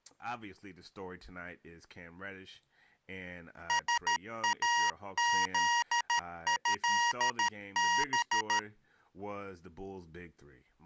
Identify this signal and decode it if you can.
Morse code (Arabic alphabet), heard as electronic beeps, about 13 wpm, 950 Hz, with speech in English. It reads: ساذهب